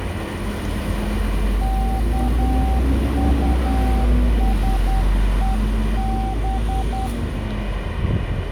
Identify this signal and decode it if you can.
Morse code, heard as a keyed tone, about 10 wpm, 770 Hz, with radio static and street noise. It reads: KUSEB